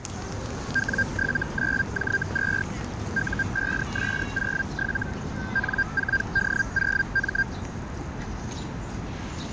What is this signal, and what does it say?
Hellschreiber (Feld-Hell, 122.5 baud), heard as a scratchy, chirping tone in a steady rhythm, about 1600 Hz, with static crashes and the noise of a park. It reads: W79J2 U5S07 N4D0M